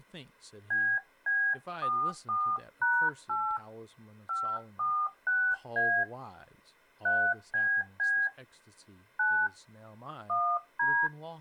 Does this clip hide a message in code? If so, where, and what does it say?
Yes: DTMF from 0.7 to 11.1 s, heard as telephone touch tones, dialled by hand, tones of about 280 ms, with speech in English. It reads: BB44#8 546A 3BB 9 1D